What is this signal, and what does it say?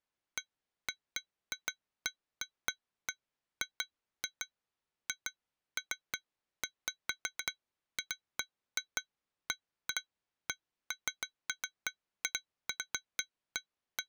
Irregular taps on glass. There is no code.